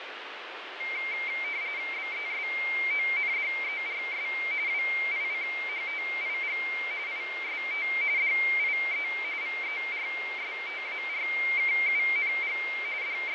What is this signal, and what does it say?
RTTY (45.45 baud, 170 Hz shift), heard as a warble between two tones, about 2200 Hz centre, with radio static and fading. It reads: BESONDERS WICHTIG IST DIE VERSTARKUNG …